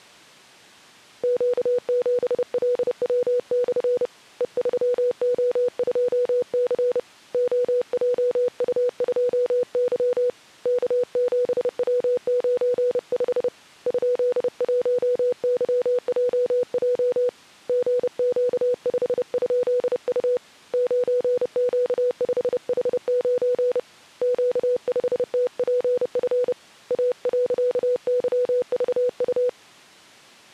Morse code, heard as a keyed tone, hand-sent with a paddle, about 30 wpm, 490 Hz. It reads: Q7LW/ E3O2C OJU2Y K7W95 ?1YJJ GQ5?U 9Q5H9 Q5TPF A.YVU